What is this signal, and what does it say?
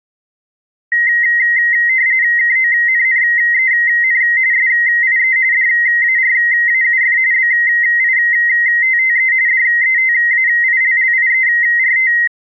RTTY (45.45 baud, 170 Hz shift), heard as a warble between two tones, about 2000 Hz centre. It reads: KONNEN SIE DARAUF BITTE DETAILLIERT